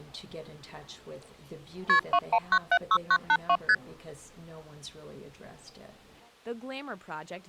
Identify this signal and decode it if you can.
Multi-frequency trunk signalling (R1, as on North American trunks), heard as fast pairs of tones, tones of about 60 ms. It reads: KP 21976982 ST